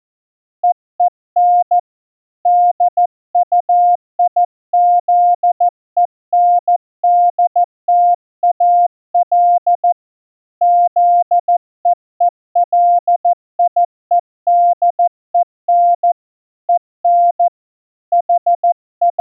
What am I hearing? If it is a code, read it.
Morse code, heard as a keyed tone, hand-sent with a paddle, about 14 wpm, 700 Hz. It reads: EEN DUIZENDTAL ZEELIEDEN EN …